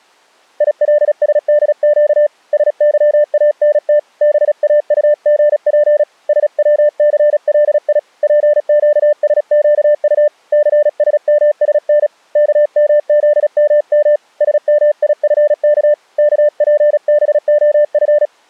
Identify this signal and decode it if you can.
Morse code, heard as a keyed tone, hand-sent with a paddle, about 36 wpm, 590 Hz. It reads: ILSDQ SYANT BAUGP SWCLI PQSQU CSMSN KMZMM SMIFK KPBOF